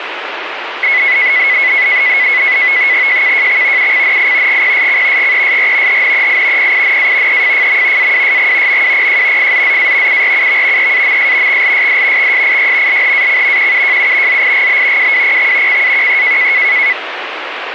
NAVTEX (SITOR-B), 100 baud, 170 Hz shift, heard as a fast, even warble, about 2100 Hz centre, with radio static. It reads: JKJX UCNI GPSC GESR HNEI PINA EFFM AWSG MWPJ FZZA URUV EAMS XLSD XSIY LHAC QUJU ZIGB WWPX CAQE